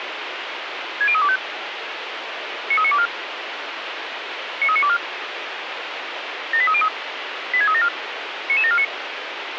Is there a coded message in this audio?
Yes: five-tone selective call (ZVEI) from 1.0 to 8.8 s, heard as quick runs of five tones, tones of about 70 ms, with radio hiss. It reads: 60325 93924 93924 78303 86374 99749